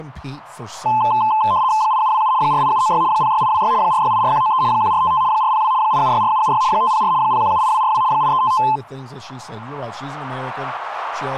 RTTY (75 baud, 170 Hz shift), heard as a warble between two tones, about 950 Hz centre, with speech in English. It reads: 8727 48796 06826 4684193 1455 402 8764776 504 0178242 8355